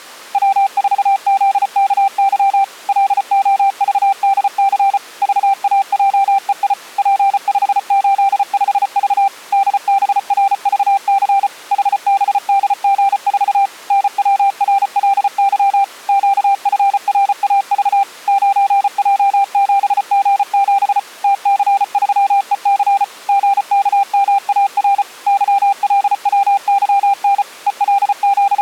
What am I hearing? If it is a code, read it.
Morse code, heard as a keyed tone, machine-sent, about 34 wpm, 790 Hz. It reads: W4ZKY LOVDC VAJEI P585V DBRVC HBDG4 NWRLY QFRAV 9J7G7 TC3EC GKMAR YLWYN …